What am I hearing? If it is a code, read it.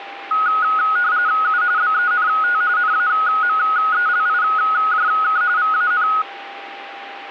RTTY (45.45 baud, 170 Hz shift), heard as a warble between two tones, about 1360 Hz centre, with a steady whistle near 800 Hz. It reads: U BENT NAMELIJK VAN